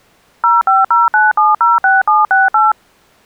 DTMF, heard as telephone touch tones, dialled by machine, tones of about 180 ms. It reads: 0509706768